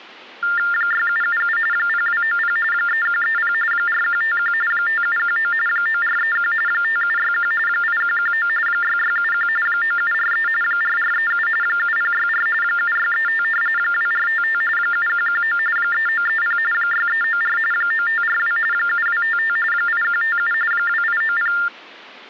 TTY/TDD text telephone tones (45.45 baud Baudot), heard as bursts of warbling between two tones, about 400 Hz shift, 1600 Hz centre. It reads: 6777 0290 3130 4151 5719 9431 5761 8119 6671 9743 4437 7064 7635 2455 7119 3930 6394 9542 7255 8157 2890